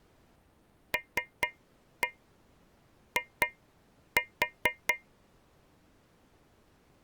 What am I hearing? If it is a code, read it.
Tap code, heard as taps on a metal pipe, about 4 knocks a second. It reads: LI